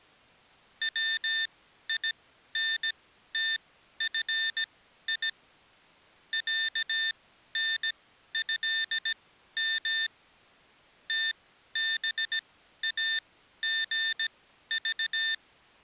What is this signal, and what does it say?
Morse code (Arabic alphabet), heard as electronic beeps, machine-sent, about 17 wpm, spaced as for 12 wpm, 1800 Hz. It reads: وينتفي عنهم تباغض